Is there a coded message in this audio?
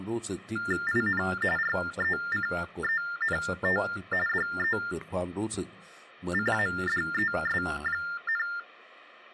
Yes: TTY/TDD text telephone tones (45.45 baud Baudot) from 0.6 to 8.6 s, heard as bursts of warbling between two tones, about 400 Hz shift, 1600 Hz centre, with speech in Thai. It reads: IN RECENT DECADES,